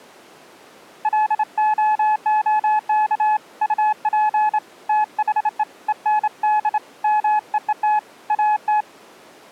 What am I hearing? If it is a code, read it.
Morse code, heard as a keyed tone, hand-sent with a straight key, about 27 wpm, 850 Hz. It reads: LOOK UP THE END MEET AT